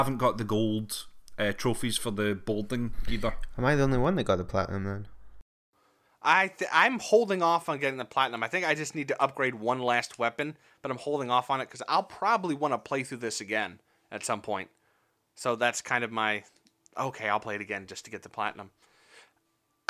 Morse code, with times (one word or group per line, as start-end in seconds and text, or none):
none